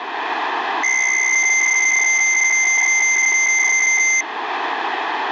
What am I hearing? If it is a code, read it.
PSK63 (62.5 baud), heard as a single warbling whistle, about 2100 Hz.